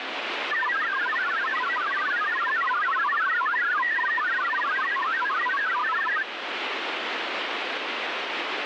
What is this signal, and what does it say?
Multi-tone FSK (Olivia or MFSK type), about 1000 Hz wide, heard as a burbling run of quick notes, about 62.5 baud, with radio static.